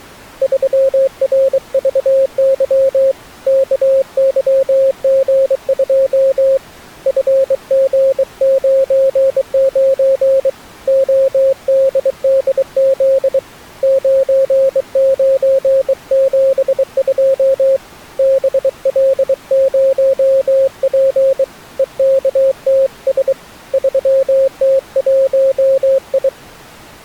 Morse code, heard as a keyed tone, hand-sent with a bug key, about 23 wpm, 540 Hz. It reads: 3RVY KYG2 FG99 ODDZ 9972 BL0P EKTS 3T1I